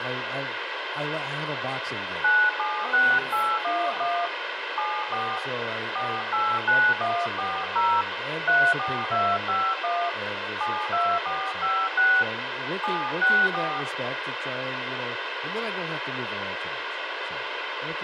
DTMF, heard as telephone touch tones, dialled by hand, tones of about 250 ms, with radio hiss, room echo and speech in English. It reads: 976811 74 489140 34251 72456 764